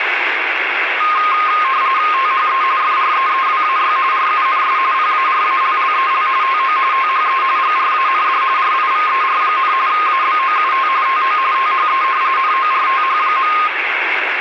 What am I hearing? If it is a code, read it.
RTTY (45.45 baud, 170 Hz shift), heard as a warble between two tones, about 1150 Hz centre, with radio static. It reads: THE FREEWAY RUNS PARALLEL TO THE GRAND RIVER, ABOUT TO THE NORTH.